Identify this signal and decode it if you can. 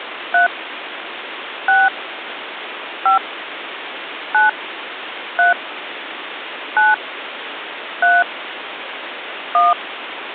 DTMF, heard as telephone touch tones, dialled by hand, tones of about 140 ms, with phone line noise. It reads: 3 6 5 9 3 9 3 1